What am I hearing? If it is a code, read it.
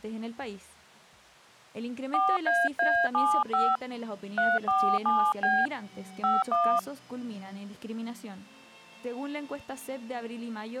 DTMF, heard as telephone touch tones, dialled by hand, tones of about 240 ms. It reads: 4AA75 347B 51